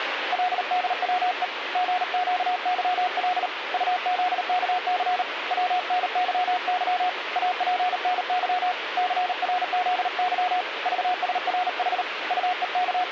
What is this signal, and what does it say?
Morse code, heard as a keyed tone, hand-sent with a paddle, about 38 wpm, 730 Hz, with radio static. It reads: LDWE GQYL UZKC WNYY APNY CRZY VSRH …